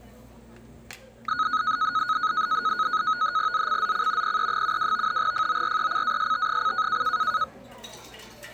NAVTEX (SITOR-B), 100 baud, 170 Hz shift, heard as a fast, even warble, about 1360 Hz centre, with the noise of a restaurant. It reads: ZCZC PE72 FORECAST: